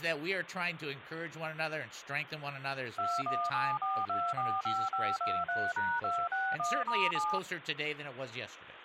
DTMF, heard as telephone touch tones, dialled by machine, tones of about 240 ms, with phone line noise and speech in English. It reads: 2174245523#261*7